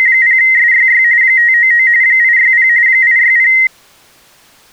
RTTY (45.45 baud, 170 Hz shift), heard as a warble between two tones, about 2000 Hz centre. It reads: … 599 860 860